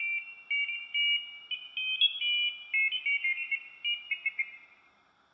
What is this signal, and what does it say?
Pairs of high tones at irregular times, with room echo. There is no code.